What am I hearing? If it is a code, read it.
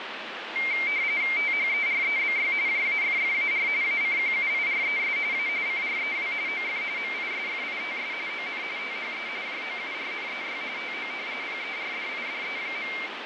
RTTY (45.45 baud, 170 Hz shift), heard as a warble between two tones, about 2200 Hz centre, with radio static and fading. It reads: THEREBY JAFFAR ACQUIRES A CREW OF MISFITS ON THE JOURNEY TO PERDIDE.